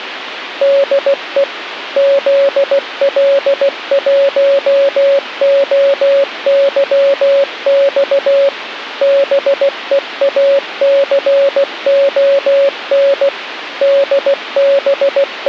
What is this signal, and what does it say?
Morse code, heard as a keyed tone, machine-sent, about 16 wpm, 560 Hz, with radio hiss. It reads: DE ZL1OYX BEACON …